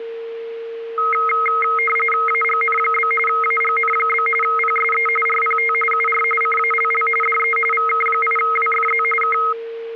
RTTY (45.45 baud, 850 Hz shift), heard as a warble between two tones, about 1700 Hz centre, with a steady whistle near 460 Hz. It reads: AGN? AGN? PSE RPT UR CALL DE VK8WFZ K